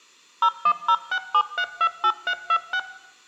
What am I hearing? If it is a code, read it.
DTMF, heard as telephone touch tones, dialled by machine, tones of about 70 ms, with room echo. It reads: 01067328326